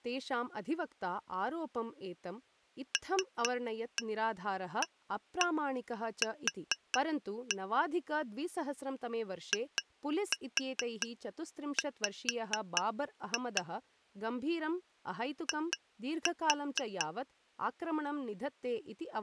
Tap code, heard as taps on glass, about 4 knocks a second, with speech in Sanskrit. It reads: LAQ IW I